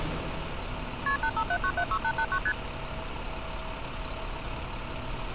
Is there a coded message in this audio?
Yes: multi-frequency trunk signalling (R1, as on North American trunks) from 1.1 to 2.5 s, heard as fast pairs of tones, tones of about 70 ms, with street noise. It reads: KP 857976889 ST